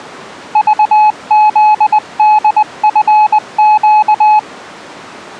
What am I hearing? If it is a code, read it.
Morse code (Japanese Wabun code), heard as a keyed tone, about 20 wpm, 850 Hz. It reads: クフホチネ